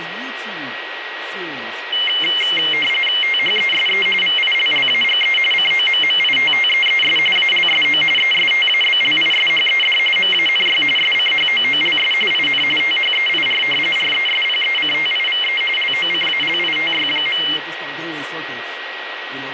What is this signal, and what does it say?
RTTY (45.45 baud, 850 Hz shift), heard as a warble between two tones, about 2550 Hz centre, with radio static, a steady whistle near 1910 Hz and speech in English. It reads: THESE VILLAGE COMMITTEES ALSO ESTABLISHED MANY SCHOOLS IN THEIR RESPECTIVE LOCALITY.